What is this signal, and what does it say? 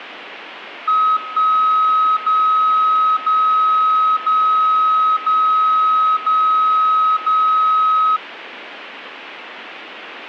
Radio time signal (DCF77), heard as a tone whose level steps once a second, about 1270 Hz. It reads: 1 0 0 0 0 0 0